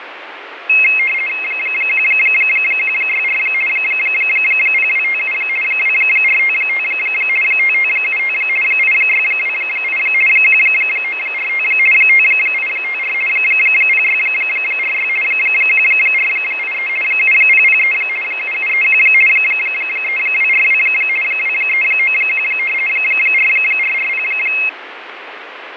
RTTY (50 baud, 450 Hz shift), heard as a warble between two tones, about 2350 Hz centre, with radio static and fading. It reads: 1164 0257 2455 5575 8628 1945 5854 0646 1483 7003 7731 3242 2391 4440